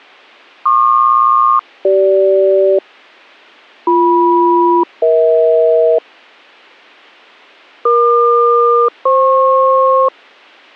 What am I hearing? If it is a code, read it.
Aircraft SELCAL, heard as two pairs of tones, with a squelch burst at the end. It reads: PQ-CG BM-EH EQ-FP